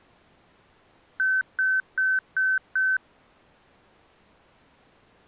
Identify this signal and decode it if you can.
Beep code, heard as beeps from a small speaker, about 1550 Hz. 5 short. In AMI BIOS tables: processor failure; in Dell tables: CMOS battery failure.